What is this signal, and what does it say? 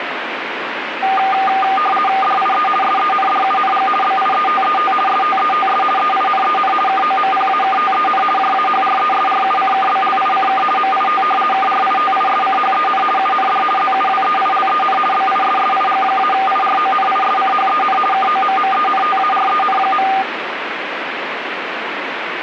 RTTY (50 baud, 450 Hz shift), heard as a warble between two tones, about 1000 Hz centre, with radio static. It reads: DIE SENDUNG BIETET STETS EINEN KOMPAKTEN JAHRESRUCKBLICK MIT KRITISCHEN UND ZUWEILEN BISSIG-IRONISCHEN KOMMENTAREN.